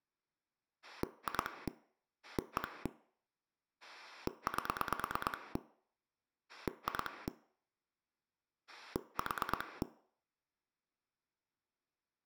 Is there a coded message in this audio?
Yes: pulse dialling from 0.8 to 9.8 s, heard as a rotary dial, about 9 pulses a second, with room echo. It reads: 2 1 8 2 4